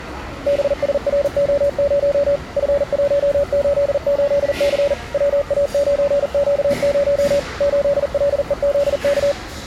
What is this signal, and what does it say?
Morse code, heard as a keyed tone, machine-sent, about 40 wpm, 570 Hz, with the noise of a restaurant. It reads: BSRO0 F188C WA9Q0 8LEZK